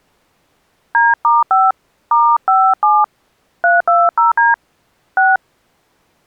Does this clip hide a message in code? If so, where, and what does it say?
Yes: DTMF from 0.9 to 5.4 s, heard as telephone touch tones, dialled by hand, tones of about 220 ms. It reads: D*5 *57 320D 6